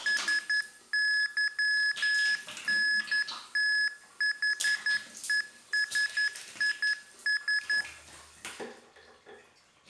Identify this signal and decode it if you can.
Morse code, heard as electronic beeps, machine-sent, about 11 wpm, 1700 Hz, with the noise of a restroom. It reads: SYNTHESIS